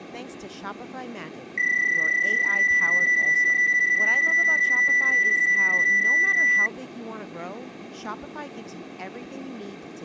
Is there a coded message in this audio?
Yes: PSK31 (31.25 baud) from 1.6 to 6.7 s, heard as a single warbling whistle, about 1950 Hz, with speech in English.